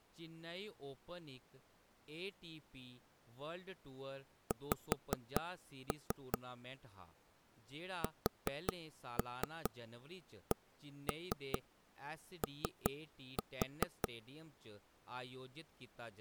Tap code, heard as taps on a table, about 5 knocks a second, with speech in Dogri. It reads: X SCO